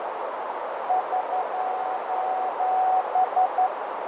Morse code, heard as a keyed tone, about 11 wpm, 750 Hz, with heavy radio static, fading and a narrow filter. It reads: <SOS>